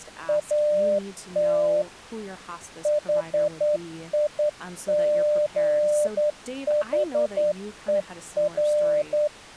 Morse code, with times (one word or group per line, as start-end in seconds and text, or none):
0.3-1.8 AT
2.9-9.3 HIGHER